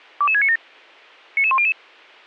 Five-tone selective call (ZVEI), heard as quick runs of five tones, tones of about 70 ms. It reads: 22697 99100